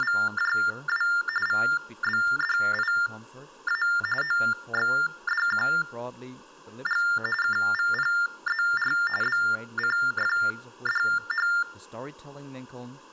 TTY/TDD text telephone tones (45.45 baud Baudot), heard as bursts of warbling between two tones, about 400 Hz shift, 1600 Hz centre, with speech in English. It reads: … VBDIA OXDQG KVPZR BCFDH